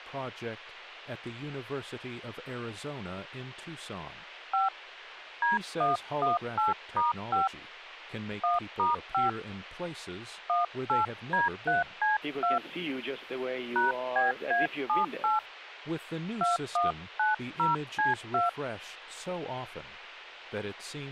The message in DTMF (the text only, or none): 5 D118*5 1*5 18D3C2 #BA78 2190C2